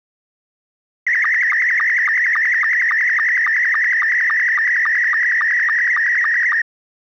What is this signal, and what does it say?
SSTV (slow-scan television), Scottie S2, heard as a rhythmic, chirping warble.